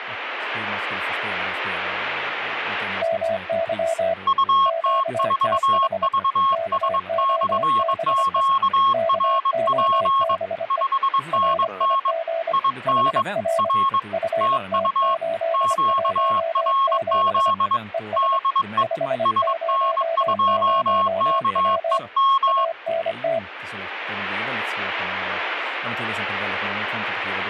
Morse code, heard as two keyed tones, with speech in Swedish. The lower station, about 25 wpm, 660 Hz: MY QTH KOBE KOBE RIG HR FT817 ES 500W ANT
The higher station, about 22 wpm, 1090 Hz: UT4VS/QRP 5NN IN R TU QRZ DE SN2KEM